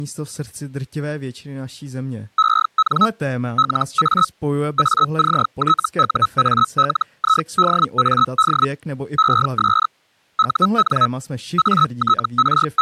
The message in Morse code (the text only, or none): none